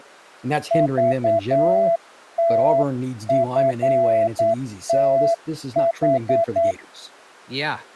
Morse code (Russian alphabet), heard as a keyed tone, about 9 wpm, 670 Hz, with speech in English. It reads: ЖТФТХ